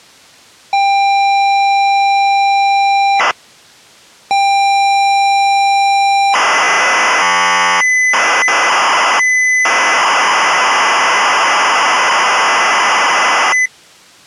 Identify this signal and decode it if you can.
ZX Spectrum tape loading, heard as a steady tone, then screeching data.